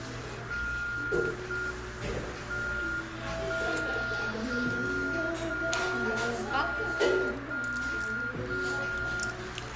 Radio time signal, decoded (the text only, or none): 0 M 1 0 0 0 0 0 0